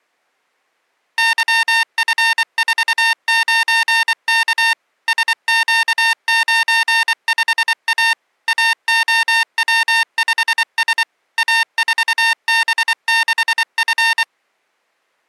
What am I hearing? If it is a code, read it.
Morse code, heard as electronic beeps, machine-sent, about 24 wpm, 910 Hz. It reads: YF49K SQ95A AOW5S A4B6F